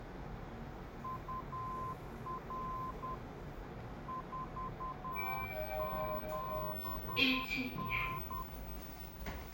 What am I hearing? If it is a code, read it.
Morse code, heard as a keyed tone, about 10 wpm, 1040 Hz, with the noise inside a lift. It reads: UR 47N